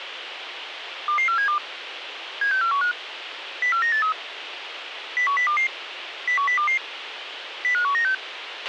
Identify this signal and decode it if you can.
Five-tone selective call (CCIR), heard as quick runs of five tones, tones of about 100 ms, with radio hiss and a squelch burst at the end. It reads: 22472 76415 04983 01022 01022 05196